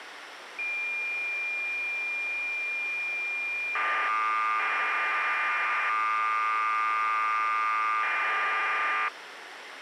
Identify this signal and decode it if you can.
Cassette data (Kansas City type), 1200 baud, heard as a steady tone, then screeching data, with tape hiss.